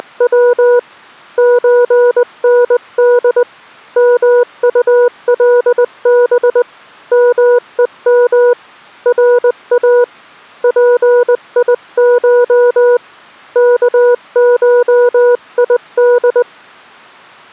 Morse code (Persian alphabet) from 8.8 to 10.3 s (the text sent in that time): را